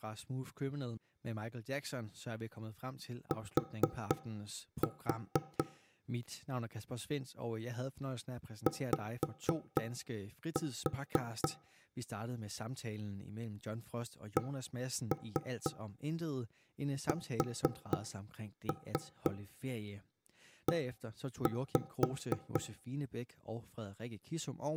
Tap code, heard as knocks on wood, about 4 knocks a second, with room echo and speech in Danish. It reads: T Y CSE